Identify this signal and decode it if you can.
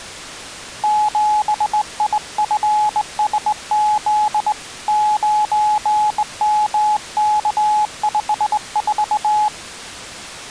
Morse code, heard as a keyed tone, hand-sent with a straight key, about 19 wpm, 850 Hz. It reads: 7IFSZ 9MK54